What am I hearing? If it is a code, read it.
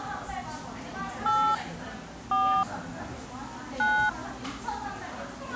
DTMF, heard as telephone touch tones, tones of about 260 ms, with the noise of a crowd indoors. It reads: 8 4 9